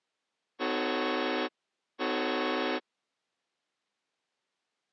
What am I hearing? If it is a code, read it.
Train horn signal, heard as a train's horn. 2 short. On North American railways: a signal is acknowledged.